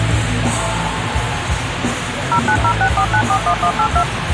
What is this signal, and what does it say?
DTMF, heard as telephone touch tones, dialled by machine, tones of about 80 ms, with phone line noise. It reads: 09064941182